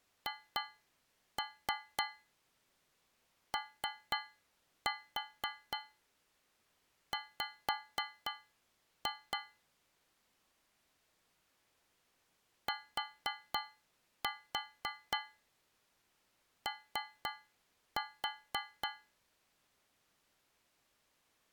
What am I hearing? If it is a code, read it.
Tap code, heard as taps on a metal pipe, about 4 knocks a second. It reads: HOW TO